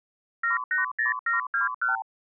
Multi-frequency trunk signalling (R2, with the far end's replies), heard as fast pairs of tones, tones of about 140 ms. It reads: 780721